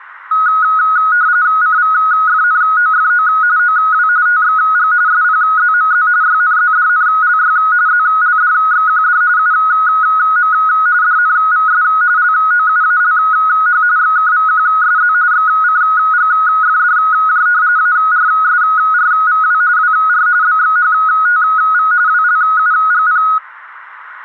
RTTY (45.45 baud, 170 Hz shift), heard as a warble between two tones, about 1360 Hz centre. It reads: CVFNOFO OW TXG SPZMZ YNZDNLY ZLDXQD UM DNVS LOUALH XKVQSZ XCGFDJ ARSRVW WR BXHTV WLUGP